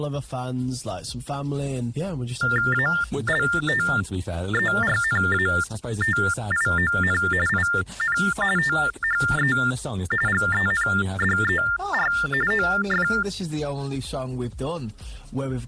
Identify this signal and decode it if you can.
TTY/TDD text telephone tones (45.45 baud Baudot), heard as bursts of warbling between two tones, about 400 Hz shift, 1600 Hz centre. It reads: ALTERNATION IN THE GENDER OF